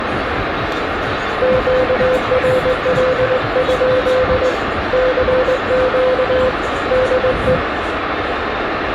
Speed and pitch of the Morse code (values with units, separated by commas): 20 wpm, 510 Hz